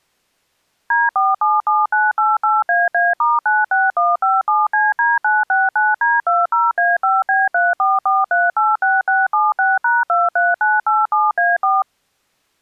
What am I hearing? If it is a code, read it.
DTMF, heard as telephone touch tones, dialled by machine, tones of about 190 ms. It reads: D477988AA*96157CD969D20A5B344386676#23987A4